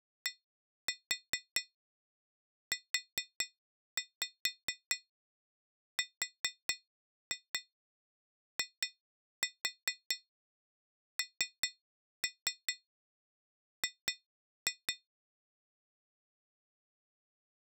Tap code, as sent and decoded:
1-4 4-5 4-2 2-4 3-3 2-2
DURING

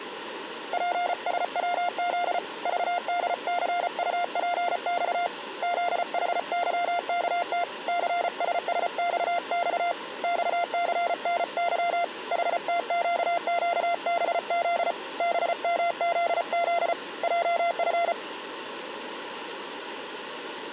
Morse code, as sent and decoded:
.--. ... .-- --.. / ...- -.. -.-. ..- .--. -..- / --.. .... -.-- -.- - / -.-. ... ... -..- -..- / -..- -.-. -. -.-- / .... - --.- --.- -... --.. / -... -- --.. --.. / .--- ..-.
PSWZ VDCUPX ZHYKT CSSXX XCNY HTQQBZ BMZZ JF

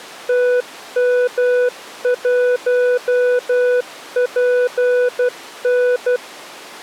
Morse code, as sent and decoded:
- -- .---- .--. -.
TM1PN

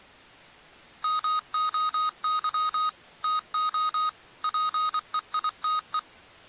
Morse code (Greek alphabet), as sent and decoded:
-- --- -.-- / - --- / .--. . .. - .
ΜΟΥ ΤΟ ΠΕΙΤΕ

